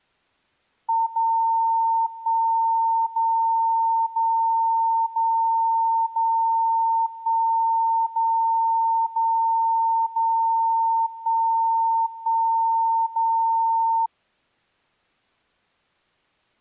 Radio time signal (DCF77), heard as a tone whose level steps once a second, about 910 Hz. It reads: 0 1 0 0 0 0 1 0 0 0 1 1 0